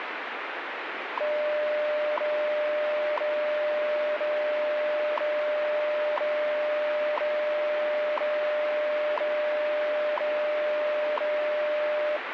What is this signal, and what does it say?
Radio time signal (WWV, Colorado), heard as ticks, one a second, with radio static.